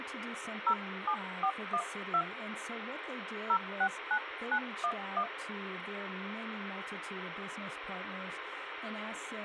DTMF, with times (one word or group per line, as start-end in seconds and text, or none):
0.7-2.2 07412
3.5-5.2 069911